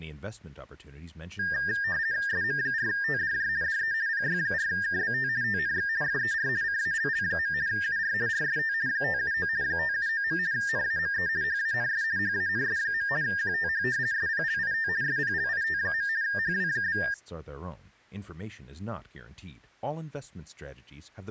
RTTY (50 baud, 170 Hz shift), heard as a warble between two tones, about 1700 Hz centre, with speech in English. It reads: SM4TDJ DE PY4KBT TNX FER CALL. UR RST 579 579. NAME HANS HANS. QTH SPLIT SPLIT. HW?